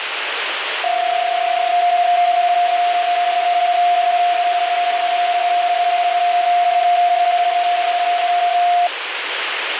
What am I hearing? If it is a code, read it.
PSK31 (31.25 baud), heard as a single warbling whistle, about 700 Hz, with radio static.